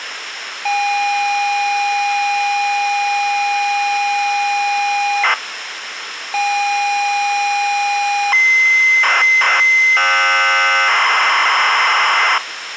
ZX Spectrum tape loading, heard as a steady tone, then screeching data, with tape hiss.